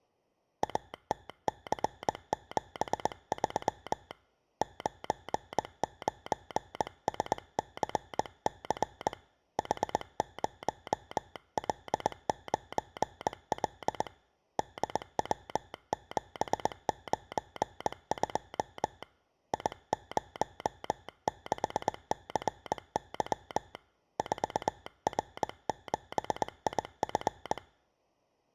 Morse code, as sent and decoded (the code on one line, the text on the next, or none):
.- - -.-. --... ...-- / ----. ----. ... -.-. -.-. / .... ----- .-.. ----. .-.. / -.. .-- --... ----. ..--- / .. ----- -.... -.-. -.-- / ....- .-. --... .. ..-.
ATC73 99SCC H0L9L DW792 I06CY 4R7IF